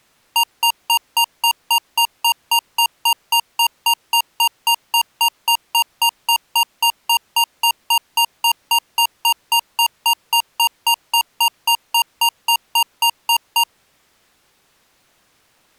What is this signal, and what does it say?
Evenly repeated beeps. There is no code.